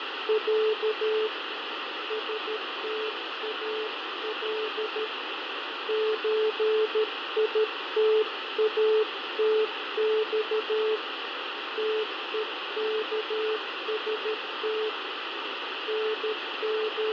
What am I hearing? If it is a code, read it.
Morse code (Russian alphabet), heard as a keyed tone, hand-sent with a paddle, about 13 wpm, 430 Hz, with heavy radio static and fading. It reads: Я СТАЛ ЧИТАТЬ ТЕКСТ …